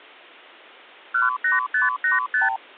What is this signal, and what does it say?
Multi-frequency trunk signalling (R2, with the far end's replies), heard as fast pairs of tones, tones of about 150 ms. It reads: 18585